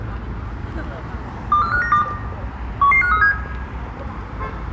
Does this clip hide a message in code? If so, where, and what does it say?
Yes: five-tone selective call (CCIR) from 1.5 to 3.3 s, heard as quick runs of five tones, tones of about 100 ms, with room echo and street noise. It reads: 24592 11537